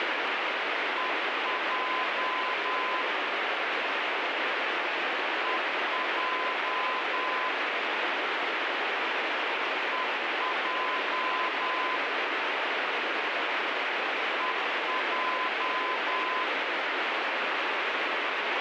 Morse code, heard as a keyed tone, machine-sent, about 10 wpm, 1020 Hz, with heavy radio static. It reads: EJ EJ EJ EJ